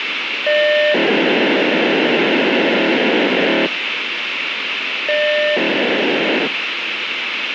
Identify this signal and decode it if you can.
POCSAG pager data (1200 baud), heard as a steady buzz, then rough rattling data, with radio hiss.